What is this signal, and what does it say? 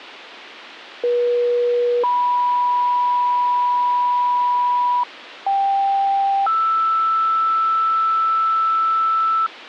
Two-tone page, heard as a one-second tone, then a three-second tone, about 480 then 980 Hz, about 790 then 1320 Hz.